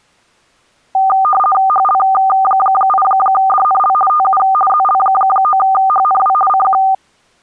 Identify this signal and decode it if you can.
RTTY (50 baud, 450 Hz shift), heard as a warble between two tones, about 990 Hz centre. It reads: HL8DNL TU ZL9HNW CQ